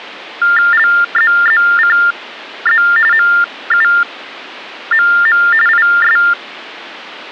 TTY/TDD text telephone tones (45.45 baud Baudot), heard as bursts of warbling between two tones, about 400 Hz shift, 1600 Hz centre. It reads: LZZCZ MUMM IS